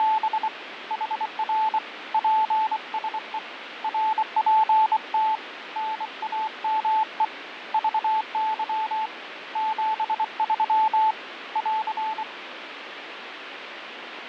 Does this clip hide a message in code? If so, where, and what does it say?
Yes: Morse code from 0.0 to 12.3 s, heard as a keyed tone, hand-sent with a bug key, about 24 wpm, 870 Hz, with radio static and fading. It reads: … HR PSE RPT NAME VY 73 <AR>